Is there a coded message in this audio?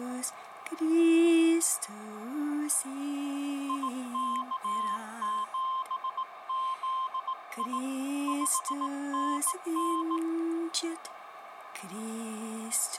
Yes: Morse code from 3.6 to 10.2 s, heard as a keyed tone, hand-sent with a bug key, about 18 wpm, 1050 Hz, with radio static, a narrow filter and room echo. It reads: IK7ZI 5NN